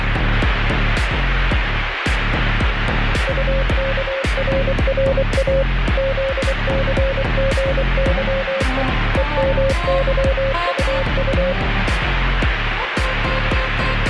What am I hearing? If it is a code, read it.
Morse code, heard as a keyed tone, machine-sent, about 24 wpm, 540 Hz, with radio static. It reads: UKRRA ZCGYE EMYUU